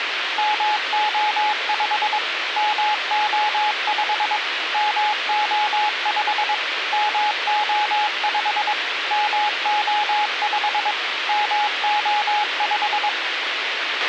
Morse code, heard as a keyed tone, machine-sent, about 22 wpm, 840 Hz, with radio hiss and a squelch burst at the end. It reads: MO5 MO5 MO5 MO5 MO5 MO5